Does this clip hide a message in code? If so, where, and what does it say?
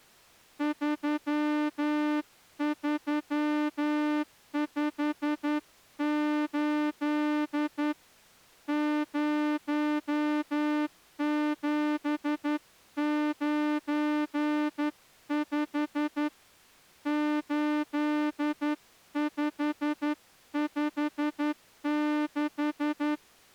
Yes: Morse code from 0.5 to 23.2 s, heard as a horn, hand-sent with a straight key, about 11 wpm. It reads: 3358 0795 8556